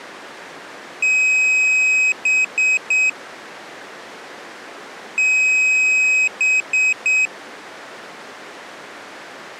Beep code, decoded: 1 long, 3 short

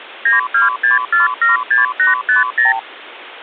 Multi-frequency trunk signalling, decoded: 926476850

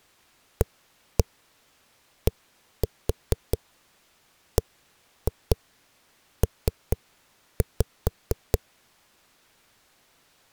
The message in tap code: ADBP

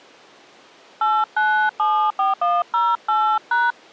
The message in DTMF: 8974108#

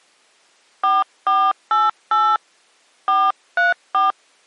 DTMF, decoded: 4488 434

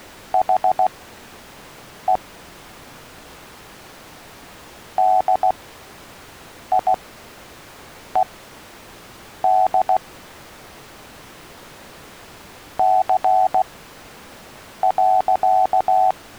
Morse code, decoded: HE DIED C.

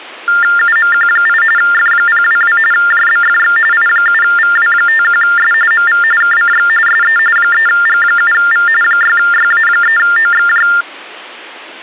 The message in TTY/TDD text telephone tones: UMQ8 F022 JBFX I7VW51S MV KCX SE 3G7V 6YA3OXJ

